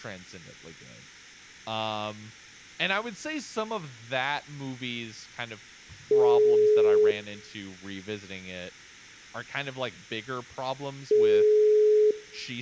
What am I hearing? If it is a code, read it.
Telephone call progress tone (single-tone plan, as in most of Europe), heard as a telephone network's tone, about 420 Hz, 1 s on and 4 s off, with speech in English. Ringback tone.